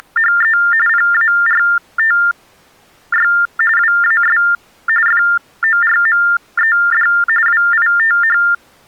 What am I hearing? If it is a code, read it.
TTY/TDD text telephone tones (45.45 baud Baudot), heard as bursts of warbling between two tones, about 400 Hz shift, 1600 Hz centre. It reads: … PARTY WAS FORMED WITH